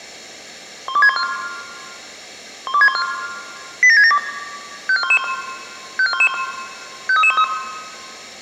Five-tone selective call (ZVEI), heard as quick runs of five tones, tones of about 70 ms, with room echo. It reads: 12614 12614 87672 54111 54111 53313